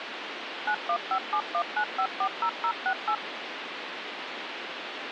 DTMF, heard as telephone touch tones, dialled by machine, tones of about 80 ms, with phone line noise. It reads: 915719540068